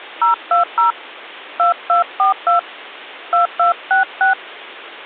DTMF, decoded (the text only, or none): 020 2242 2266